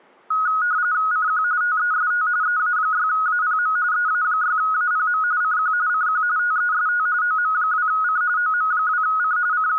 RTTY (45.45 baud, 170 Hz shift), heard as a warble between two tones, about 1360 Hz centre. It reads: CQ TEST EA6APM EA6APM CQ CQ TEST OM2C OM2C …